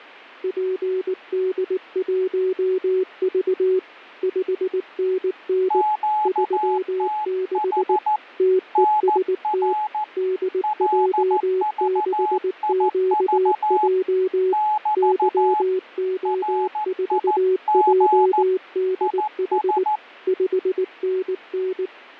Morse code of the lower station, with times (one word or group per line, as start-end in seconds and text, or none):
0.4-3.8 PD1V
4.2-5.8 5NN
6.3-8.0 36
8.4-9.7 TEST
10.2-14.5 DJ6QJ
15.0-19.8 YO4JDH
20.3-21.9 5NN